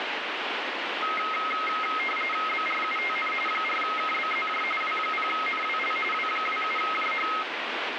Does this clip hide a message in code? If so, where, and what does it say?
Yes: RTTY (45.45 baud, 850 Hz shift) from 1.0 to 7.4 s, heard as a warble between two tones, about 1700 Hz centre, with radio static. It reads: BRUTN 4KBZJ W0NWL W27JH